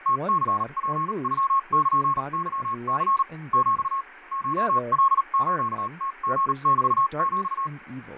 Morse code (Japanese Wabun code), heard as a keyed tone, machine-sent, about 38 wpm, spaced as for 33 wpm, 1090 Hz, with radio static, fading and speech in English. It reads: ムニツノルケニ ヒ コカスムリメヒ